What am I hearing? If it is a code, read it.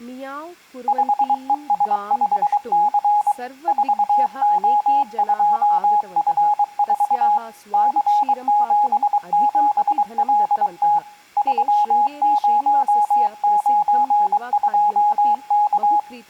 Morse code, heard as a keyed tone, hand-sent with a paddle, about 23 wpm, 830 Hz, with room echo and speech in Sanskrit. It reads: 5ES5C 4O2F4 C77LT 3092K